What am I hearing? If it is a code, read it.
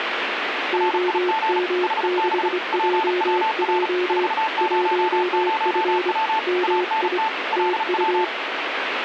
Morse code, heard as two keyed tones, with radio static. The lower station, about 25 wpm, 360 Hz: OM6JJ 1F MI TU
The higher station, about 35 wpm, 880 Hz: RIG HB PWR 400W ANT LW